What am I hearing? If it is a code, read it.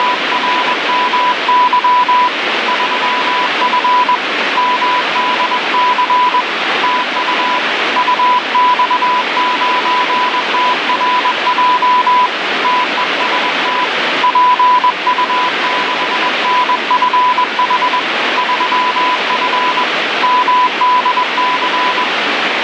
Morse code, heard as a keyed tone, hand-sent with a paddle, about 21 wpm, 990 Hz, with heavy radio static. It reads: … 3F MDC TU UX9TRJ TEST PU6NFH 3F MDC